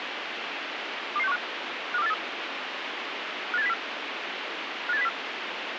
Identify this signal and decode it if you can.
Five-tone selective call (EEA), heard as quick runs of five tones, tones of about 40 ms, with radio hiss. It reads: 22615 52483 58704 58704